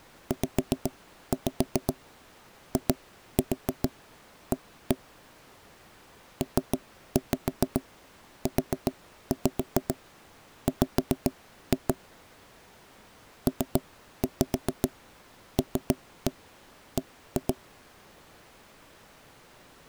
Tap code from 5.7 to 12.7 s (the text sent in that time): PUW